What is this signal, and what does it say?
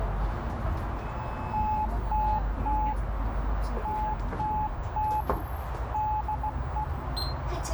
Morse code, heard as a keyed tone, hand-sent with a straight key, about 16 wpm, 860 Hz, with radio static, a narrow filter and the noise inside a bus. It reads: TTT TTT DE